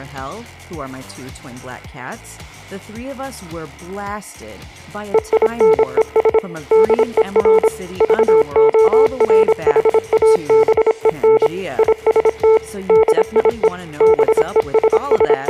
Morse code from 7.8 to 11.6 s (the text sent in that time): VORHABEN